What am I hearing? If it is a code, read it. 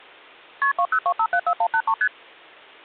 Multi-frequency trunk signalling (R1, as on North American trunks), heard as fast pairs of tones, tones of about 70 ms. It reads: KP 202574183 ST